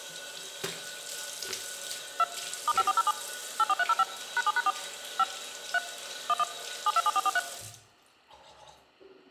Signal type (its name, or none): DTMF